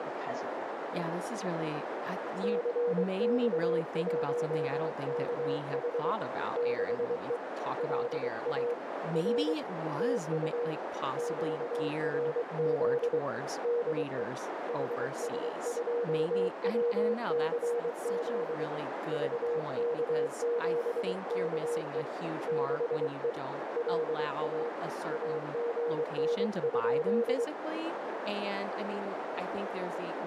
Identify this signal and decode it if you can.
Morse code, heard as a keyed tone, hand-sent with a paddle, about 23 wpm, 480 Hz, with heavy radio static, a narrow filter and speech in English. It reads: CX1KH 6E LA R TU QRZ DE HS2WCZ VK7KE 6E LA AGN?